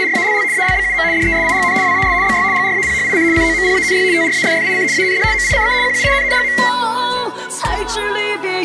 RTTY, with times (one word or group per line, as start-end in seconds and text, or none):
0.0-0.4 …
0.5-1.0 ALBUM
1.1-1.7 DESIGN
1.8-2.1 WAS
2.2-2.4 BY
2.5-3.2 GRAPHIC
3.3-4.0 COMPANY
4.1-4.8 TRAFFIC
4.9-5.2 AND
5.3-5.7 MICK
5.8-6.5 QUINN.